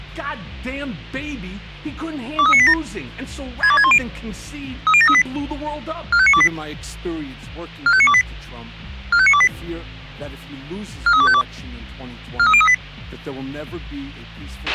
Five-tone selective call (ZVEI), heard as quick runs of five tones, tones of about 70 ms, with a squelch burst at the end. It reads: 23987 62610 30738 45928 45928 45928 43252 43038